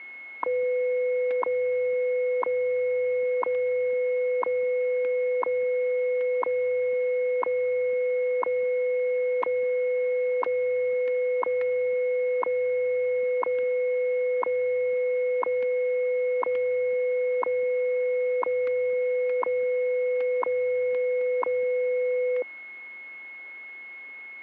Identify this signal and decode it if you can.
Radio time signal (WWV, Colorado), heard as ticks, one a second, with static crashes and a steady whistle near 2180 Hz.